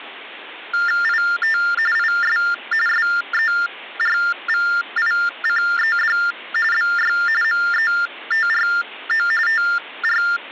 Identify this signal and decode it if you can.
TTY/TDD text telephone tones (45.45 baud Baudot), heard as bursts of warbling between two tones, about 400 Hz shift, 1600 Hz centre. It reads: IT IS SERVICED BY METRO …